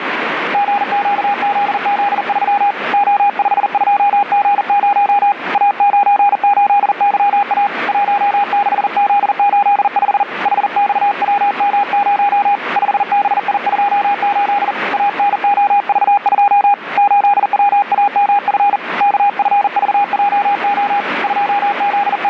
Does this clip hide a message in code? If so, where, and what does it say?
Yes: Morse code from 0.5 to 22.3 s, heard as a keyed tone, hand-sent with a paddle, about 40 wpm, 810 Hz, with radio static. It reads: GQZZ3 O52G0 A98YA 16Z85 HXWM0 5BI28 ANOV2 8WAMF KFVJO …